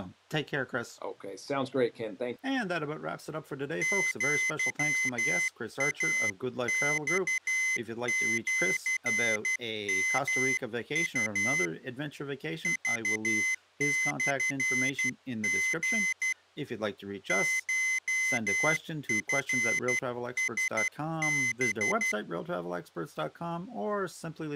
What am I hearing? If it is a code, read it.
Morse code (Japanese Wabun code), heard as a high beeper, hand-sent with a paddle, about 12 wpm, 2050 Hz, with speech in English. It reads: アイマシヨウ クモリ コチラハ